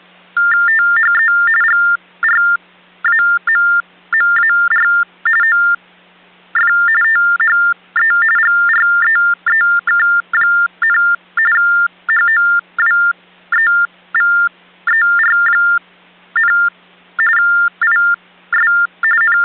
TTY/TDD text telephone tones (45.45 baud Baudot), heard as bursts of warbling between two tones, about 400 Hz shift, 1600 Hz centre, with hum. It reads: THE GRAMMAR OF THE GREEK, HOWEVER, IS …